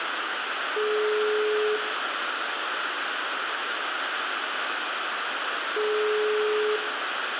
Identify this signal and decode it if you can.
Telephone call progress tone (single-tone plan, as in most of Europe), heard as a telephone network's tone, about 420 Hz, 1 s on and 4 s off, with phone line noise and room echo. Ringback tone.